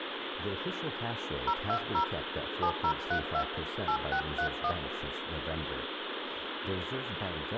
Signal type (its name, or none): DTMF